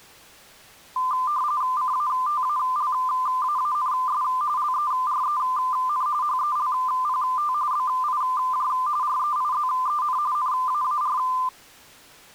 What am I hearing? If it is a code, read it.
RTTY (45.45 baud, 170 Hz shift), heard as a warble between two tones, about 1110 Hz centre. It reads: CATALAANS LEREN HELPT BIJ REIZEN NAAR